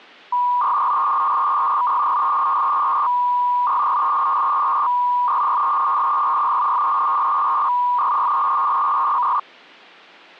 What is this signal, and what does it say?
300-baud modem data (V.21 tones), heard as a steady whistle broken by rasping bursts, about 300 baud, 200 Hz shift.